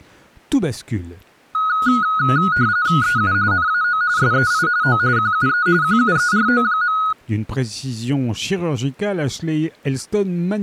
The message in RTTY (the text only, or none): EU NAO SEI O QUE QUERO.